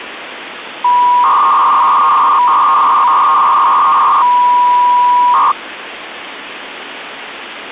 300-baud modem data (V.21 tones), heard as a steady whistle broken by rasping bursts, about 300 baud, 200 Hz shift, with phone line noise.